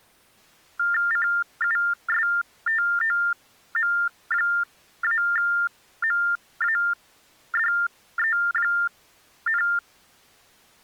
TTY/TDD text telephone tones (45.45 baud Baudot), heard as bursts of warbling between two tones, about 400 Hz shift, 1600 Hz centre. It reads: CUSTOM-MADE,